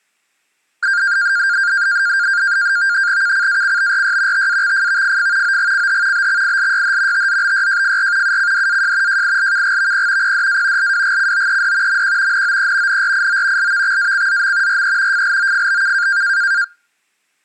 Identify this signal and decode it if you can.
NAVTEX (SITOR-B), 100 baud, 170 Hz shift, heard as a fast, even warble, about 1500 Hz centre. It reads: KCACBRY TAXFVFF OGCH BXILYH TZBYJFR UCDAJ JILKGVP PDA LWGCOED MQ NOE NRIO LVXACZM RE FLOFBK